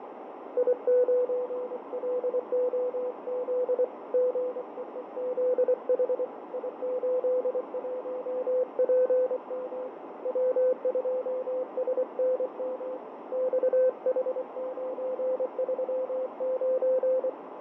Morse code, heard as a keyed tone, hand-sent with a paddle, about 24 wpm, 510 Hz, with heavy radio static, fading and a narrow filter. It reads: I9LOZ GEEZH I81PM W2SNM XH939